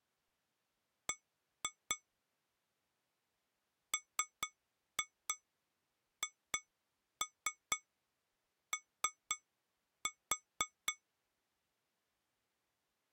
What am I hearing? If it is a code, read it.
Tap code, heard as taps on glass, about 4 knocks a second. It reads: B MHO